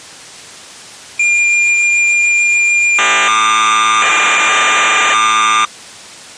Cassette data (Kansas City type), 1200 baud, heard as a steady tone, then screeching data.